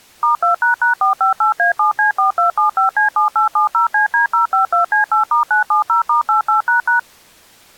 DTMF, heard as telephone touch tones, dialled by machine, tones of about 120 ms. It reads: *2##458A7C4275C7870CD052C8*970*88##